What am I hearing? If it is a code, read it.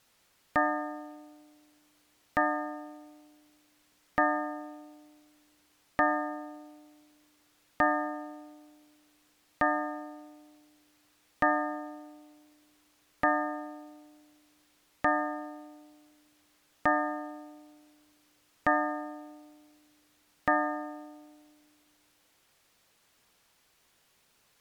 Clock strike, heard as a bell. 12. Twelve o'clock.